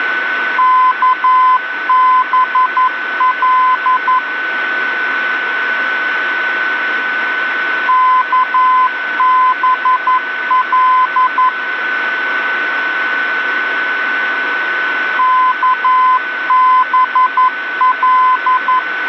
Morse code, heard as a keyed tone, machine-sent, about 11 wpm, 1020 Hz, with radio static and a steady whistle near 1500 Hz. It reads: KBL KBL KBL